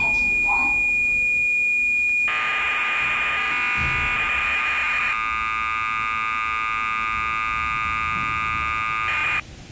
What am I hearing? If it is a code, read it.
Cassette data (Kansas City type), 1200 baud, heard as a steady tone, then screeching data, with the noise inside a lift.